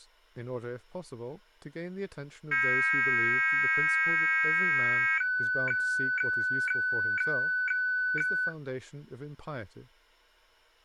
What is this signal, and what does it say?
Weather fax (radiofax), 120 lines a minute, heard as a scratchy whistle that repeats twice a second, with speech in English.